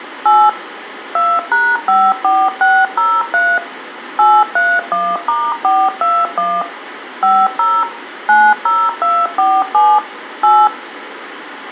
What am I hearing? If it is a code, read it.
DTMF, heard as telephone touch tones, dialled by machine, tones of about 240 ms, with phone line noise and room echo. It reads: 8 2#54603 831*421 50 90247 8